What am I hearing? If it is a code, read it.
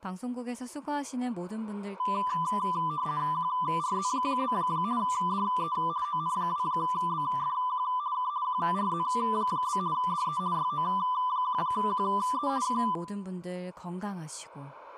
RTTY (50 baud, 170 Hz shift), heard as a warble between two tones, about 1090 Hz centre, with room echo and speech in Korean. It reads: QRZ? DE ON2BFQ K QRZ? DE YO1QE K